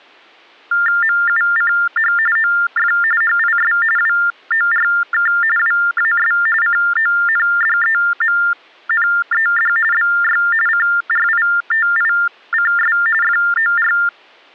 TTY/TDD text telephone tones (45.45 baud Baudot), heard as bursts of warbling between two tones, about 400 Hz shift, 1600 Hz centre. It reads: MUCH OF HIS WORK WAS CONDEMNED BY CRITICS FOR